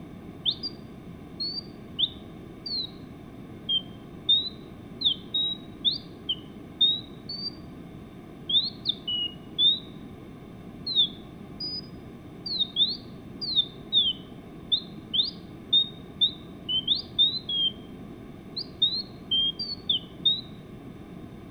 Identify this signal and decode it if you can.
Bird-like chirps. There is no code.